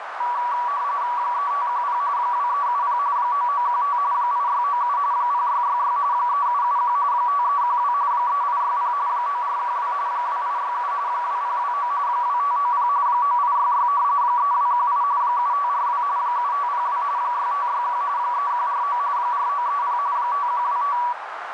RTTY (45.45 baud, 170 Hz shift), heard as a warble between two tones, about 1060 Hz centre, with radio static and a narrow filter. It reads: 3510 2370 9915 8697 0666 3771 5312 3860 9412 2867 2029 2590 9866 3218 7542 7502 6561 3149 4930 5125